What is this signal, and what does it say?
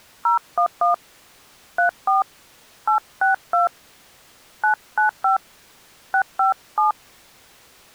DTMF, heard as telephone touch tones, dialled by hand, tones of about 120 ms. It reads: 011 34 862 995 657